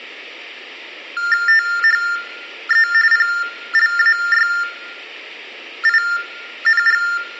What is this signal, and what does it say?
TTY/TDD text telephone tones (45.45 baud Baudot), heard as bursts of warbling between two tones, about 400 Hz shift, 1600 Hz centre, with room echo. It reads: THE PLAYING